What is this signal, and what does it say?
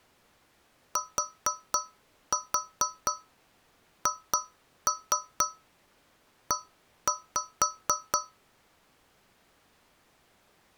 Tap code, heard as taps on a metal pipe, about 4 knocks a second. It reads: THE